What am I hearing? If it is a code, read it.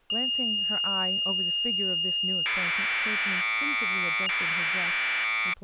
Commodore tape loading (standard loader), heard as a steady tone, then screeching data, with speech in English.